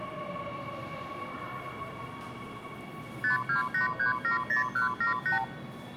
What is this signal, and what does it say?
Multi-frequency trunk signalling (R2, with the far end's replies), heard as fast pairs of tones, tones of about 130 ms, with the noise of a subway station. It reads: 528370178